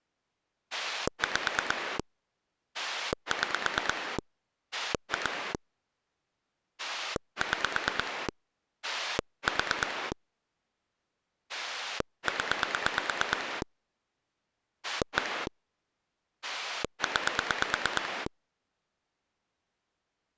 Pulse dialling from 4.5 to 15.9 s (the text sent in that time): 2 6 4 0 1